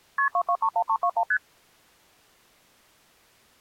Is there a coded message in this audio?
Yes: multi-frequency trunk signalling (R1, as on North American trunks) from 0.2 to 1.4 s, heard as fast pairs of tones, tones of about 70 ms. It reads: KP 2231321 ST